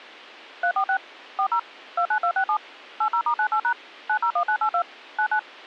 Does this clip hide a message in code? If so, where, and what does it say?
Yes: DTMF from 0.6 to 5.4 s, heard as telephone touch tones, dialled by machine, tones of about 80 ms. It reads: 346 40 29267 80*98# 901982 99